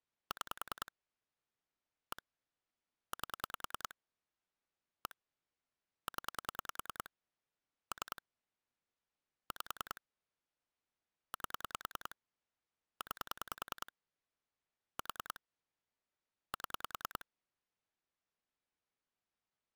Pulse dialling, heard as clicks on a phone line, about 10 pulses a second. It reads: 6 1 8 1 0 3 5 8 9 4 7